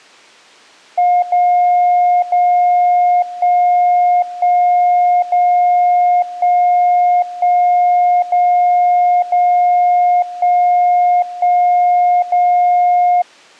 Radio time signal (DCF77), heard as a tone whose level steps once a second, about 710 Hz. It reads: 0 0 1 1 0 1 1 0 0 1 1 0